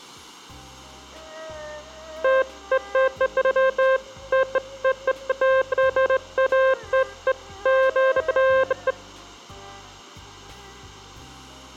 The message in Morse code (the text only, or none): none